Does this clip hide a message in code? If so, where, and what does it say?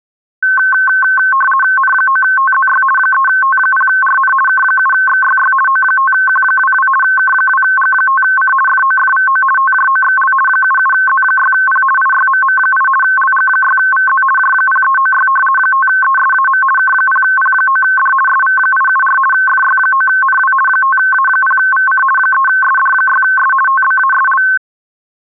Yes: RTTY (50 baud, 450 Hz shift) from 0.4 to 24.6 s, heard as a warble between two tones, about 1300 Hz centre. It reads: N9TZY 3T0RN K7XYY O5Q22 K2G5C FOFVO TJOXL 77Z6P IYMM8 LG6VZ J0396 5ESAM K0P9D SV874 FY9NW 5A0VC 3SD6S TBASL